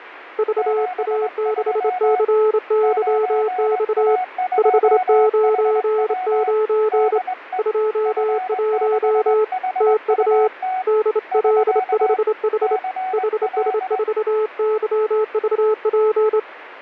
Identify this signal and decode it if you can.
Morse code, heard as two keyed tones, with radio static. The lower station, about 27 wpm, 430 Hz: VA6CYX 599 21 TU DL5H HS4YVP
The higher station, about 21 wpm, 740 Hz: 73 9A2HW DE F6HUT <SK> CL